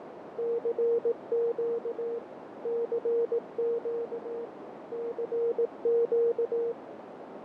Morse code, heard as a keyed tone, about 18 wpm, 470 Hz, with heavy radio static, fading and a narrow filter. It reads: CQ CQ CQ